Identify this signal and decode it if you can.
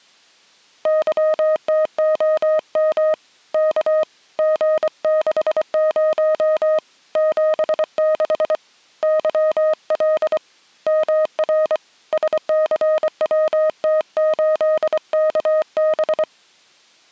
Morse code, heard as a keyed tone, hand-sent with a paddle, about 24 wpm, 620 Hz. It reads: YTOM K G60 76 YL MR SCWT8KB